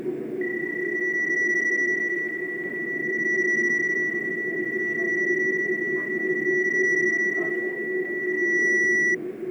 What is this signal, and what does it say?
PSK31 (31.25 baud), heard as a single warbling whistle, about 1950 Hz, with fading, static crashes and the noise inside a subway train.